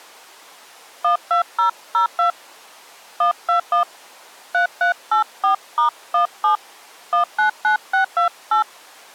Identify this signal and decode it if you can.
DTMF, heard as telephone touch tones, dialled by hand, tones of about 110 ms. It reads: 12002 121 3384*17 199628